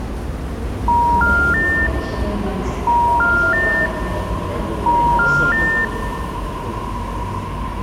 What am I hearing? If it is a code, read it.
Telephone call progress tone (ITU plan), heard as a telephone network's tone, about 950, 1400, 1800 Hz, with room echo and the noise of a subway station. Special information tone.